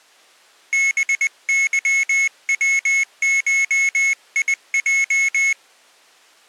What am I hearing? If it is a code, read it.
Morse code (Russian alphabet), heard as a high beeper, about 20 wpm, 2200 Hz. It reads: БЫВШИЙ